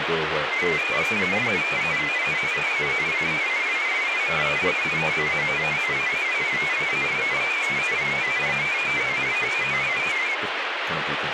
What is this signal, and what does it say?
Multi-tone FSK (Olivia or MFSK type), about 500 Hz wide, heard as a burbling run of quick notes, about 31.25 baud, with radio static.